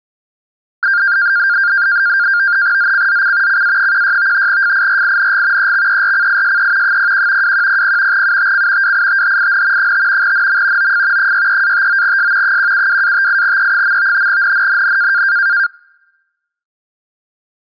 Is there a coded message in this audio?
Yes: NAVTEX (SITOR-B), 100 baud, 170 Hz shift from 0.8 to 15.7 s, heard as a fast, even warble, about 1500 Hz centre. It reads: ZCZC CA16 FIRING EXERCISE 01 2100 UTC WITHIN 5 NM OF 63-59S 172-58E. NNNN